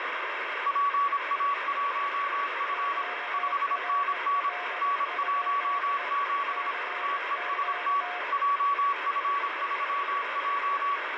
Morse code, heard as two keyed tones, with heavy radio static. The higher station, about 26 wpm, 1130 Hz: PA1F 5NN N17 TEST JF3J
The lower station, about 19 wpm, 720 Hz: QRL? CQ